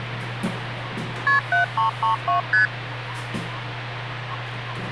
Multi-frequency trunk signalling (R1, as on North American trunks), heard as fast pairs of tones, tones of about 120 ms, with phone line noise and the noise inside a lift. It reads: KP 7332 ST